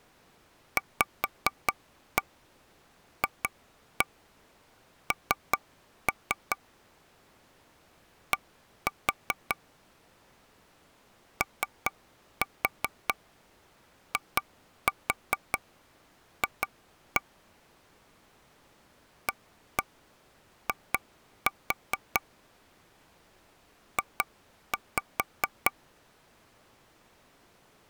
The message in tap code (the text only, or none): VFN D OIF AI J